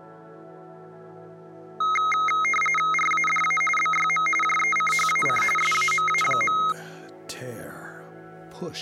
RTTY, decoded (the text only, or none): RADA BYM JECHAC SAMA.